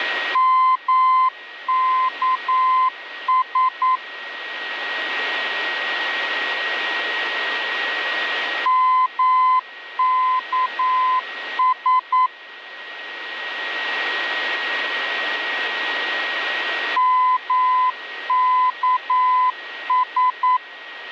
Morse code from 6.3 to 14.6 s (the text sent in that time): MKS